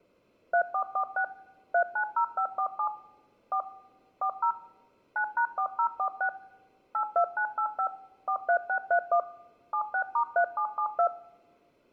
DTMF, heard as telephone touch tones, dialled by machine, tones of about 80 ms, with room echo. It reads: 3446 390547 4 40 9#4046 82985 43631 76*3772